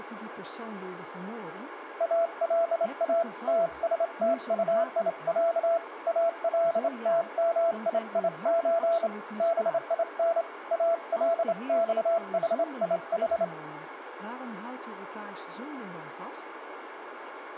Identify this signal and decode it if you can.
Morse code (Arabic alphabet), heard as a keyed tone, hand-sent with a straight key, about 27 wpm, 670 Hz, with radio static and speech in Dutch. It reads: الا تستطيع التمييز بين الصحيح